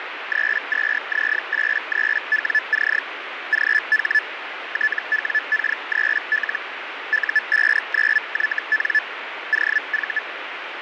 Hellschreiber (Feld-Hell, 122.5 baud), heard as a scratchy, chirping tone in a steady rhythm, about 1750 Hz, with radio static and fading. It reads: 32Z83WC GH TWK3L U59YN OV